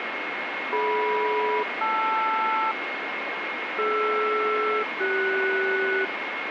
Aircraft SELCAL, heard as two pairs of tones, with radio static and a steady whistle near 2160 Hz. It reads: DM-LR DR-CS